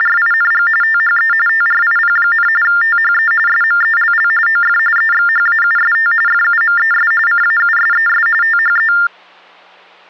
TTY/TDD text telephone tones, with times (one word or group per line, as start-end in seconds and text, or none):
0.0-0.7 …
0.8-1.3 THE
1.5-2.5 TRIP,
2.6-3.3 THE
3.5-4.3 SMELL
4.5-4.8 OF
5.0-6.1 EXHAUST
6.3-7.1 FUMES
7.3-8.3 CAUSES
8.4-8.9 THE